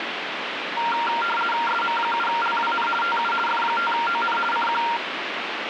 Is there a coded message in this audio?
Yes: RTTY (50 baud, 450 Hz shift) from 0.8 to 5.0 s, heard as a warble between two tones, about 1160 Hz centre, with radio static. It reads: SM7LWN TU F5ON CQ